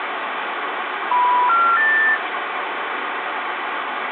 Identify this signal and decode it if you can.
Telephone call progress tone (North American plan), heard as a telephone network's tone, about 980, 1370, 1800 Hz, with phone line noise. Special information tone.